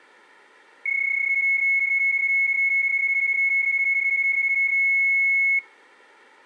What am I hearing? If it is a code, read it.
PSK31 (31.25 baud), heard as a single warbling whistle, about 2200 Hz, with room echo.